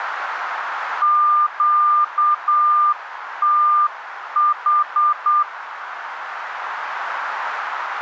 Morse code, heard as a keyed tone, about 8 wpm, 1200 Hz, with radio static. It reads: QTH